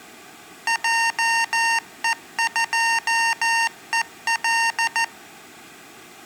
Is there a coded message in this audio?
Yes: Morse code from 0.6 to 5.1 s, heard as electronic beeps, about 14 wpm, 920 Hz. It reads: JE2EL